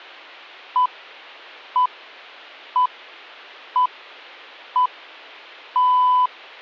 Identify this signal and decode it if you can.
Radio time signal (six pips, as the Greenwich Time Signal), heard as pips.